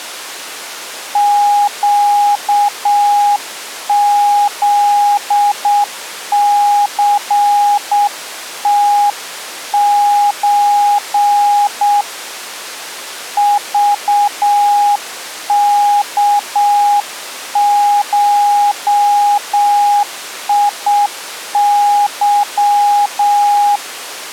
Morse code (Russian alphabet), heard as a keyed tone, hand-sent with a straight key, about 7 wpm, 820 Hz. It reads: ЩЗЦТЧ ЖКШИЫ